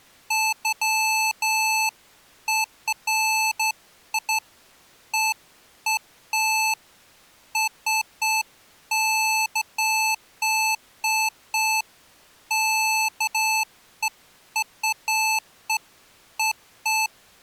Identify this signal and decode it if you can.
Beeps of irregular length. There is no code.